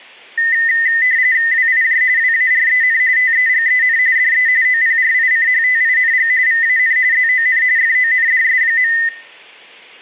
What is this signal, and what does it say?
RTTY (45.45 baud, 170 Hz shift), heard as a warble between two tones, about 1900 Hz centre. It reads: WIJ WAREN TEGEN DE OPRICHTING VAN ZON FONDS.